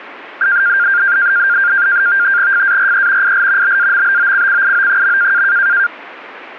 NAVTEX (SITOR-B), 100 baud, 170 Hz shift, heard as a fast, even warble, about 1500 Hz centre. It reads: FARE IL BAMBOCCIO.